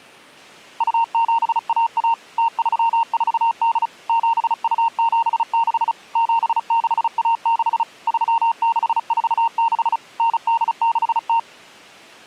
Morse code (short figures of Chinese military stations), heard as a keyed tone, machine-sent, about 35 wpm, 920 Hz. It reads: 2711 0348 7276 7616 3646 9860